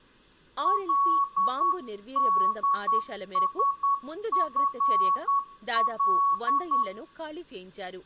Morse code, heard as a keyed tone, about 10 wpm, 1120 Hz, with room echo and speech in Telugu. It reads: LDSFL